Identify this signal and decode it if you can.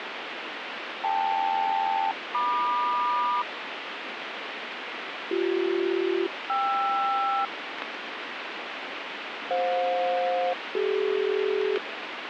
Aircraft SELCAL, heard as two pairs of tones, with radio static. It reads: KL-MQ BC-KR FJ-CD